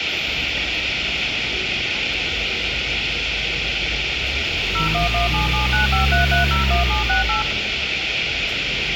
DTMF, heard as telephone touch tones, dialled by machine, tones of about 130 ms, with radio hiss and street noise. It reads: 01177953301768